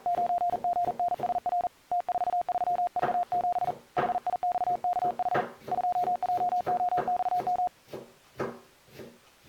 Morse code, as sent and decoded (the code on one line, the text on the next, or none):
----. --. -. ... .-. / - ....- ...-- ...- --... / .... .. -..- -.- .... / ..--- .--- --- -..- --
9GNSR T43V7 HIXKH 2JOXM